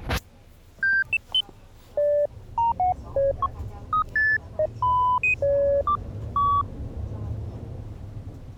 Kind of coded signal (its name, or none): none